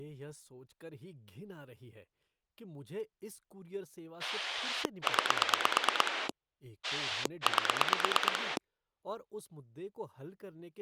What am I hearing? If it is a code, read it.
Pulse dialling, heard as a rotary dial, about 9 pulses a second, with speech in Hindi. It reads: 9 8